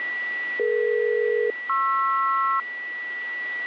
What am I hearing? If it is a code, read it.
Aircraft SELCAL, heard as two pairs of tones, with a steady whistle near 1950 Hz. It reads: DE-PR